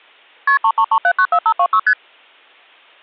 Multi-frequency trunk signalling (R1, as on North American trunks), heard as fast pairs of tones, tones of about 70 ms. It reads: KP 333794526 ST